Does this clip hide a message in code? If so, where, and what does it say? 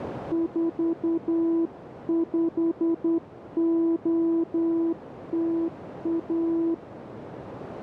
Yes: Morse code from 0.3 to 6.8 s, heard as a keyed tone, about 10 wpm, 330 Hz, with radio static and a narrow filter. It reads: 45OTA